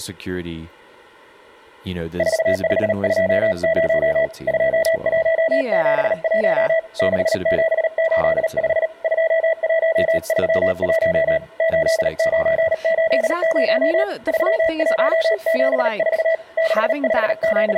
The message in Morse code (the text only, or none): 4520 2171 6785 2131 8980 3174 …